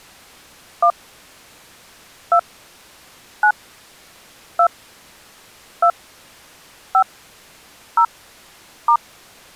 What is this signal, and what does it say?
DTMF, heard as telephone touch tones, dialled by hand, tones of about 80 ms. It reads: 1 2 9 2 2 5 0 *